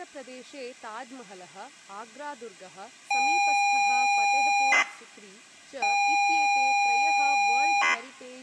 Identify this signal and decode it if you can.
ZX Spectrum tape loading, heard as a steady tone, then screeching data, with room echo and speech in Sanskrit.